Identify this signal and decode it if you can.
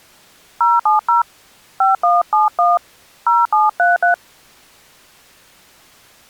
DTMF, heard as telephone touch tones, dialled by hand, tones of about 140 ms. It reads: 070 5171 0733